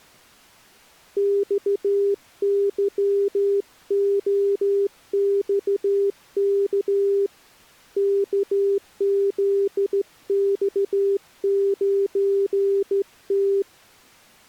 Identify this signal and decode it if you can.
Morse code, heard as a keyed tone, hand-sent with a straight key, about 14 wpm, 400 Hz. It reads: XYOXK KZX9T